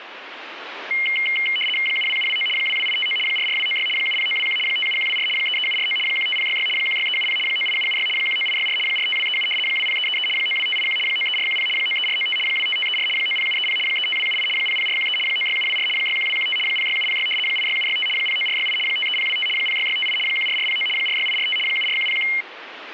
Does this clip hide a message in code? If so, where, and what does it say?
Yes: RTTY (75 baud, 850 Hz shift) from 0.9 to 22.4 s, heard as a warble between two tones, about 2550 Hz centre, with radio static. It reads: 72729 22859 44296 70921 57124 33749 15066 16370 98776 19864 45237 20333 92581 93410 93495 25534 90730 35278 00413 96724 61215 06706 86765 09468 53025 06658 14409 46845 74101